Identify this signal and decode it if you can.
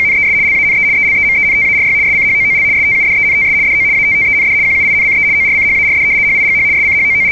RTTY (75 baud, 170 Hz shift), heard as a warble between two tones, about 2200 Hz centre. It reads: … LANE ELEMENTARY SCHOOL STUDENTS DO ATTEND QUINCE ORCHARD HIGH …